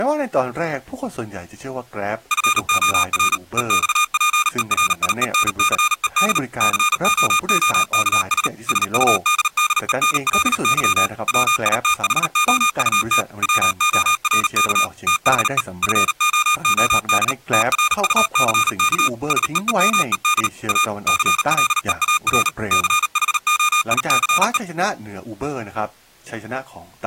Morse code, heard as electronic beeps, machine-sent, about 38 wpm, 1220 Hz, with speech in Thai. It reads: FOR EXPERIENCED COOKS SUDDENLY WITHOUT WORK THE FOOD TRUCK SEEMED A CLEAR CHOICE